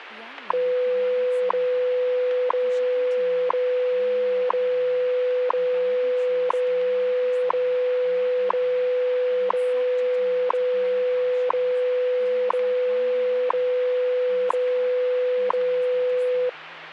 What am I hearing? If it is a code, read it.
Radio time signal (WWV, Colorado), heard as ticks, one a second, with radio static and speech in English.